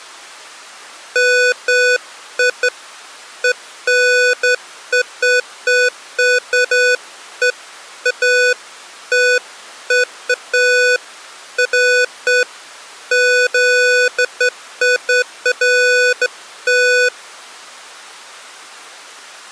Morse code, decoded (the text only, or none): none